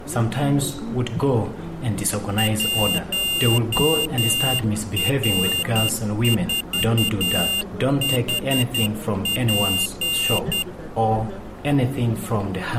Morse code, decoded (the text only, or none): 1R4HP